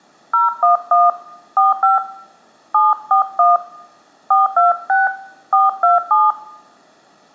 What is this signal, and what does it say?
DTMF, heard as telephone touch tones, dialled by hand, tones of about 160 ms, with room echo. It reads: 011 45 741 426 427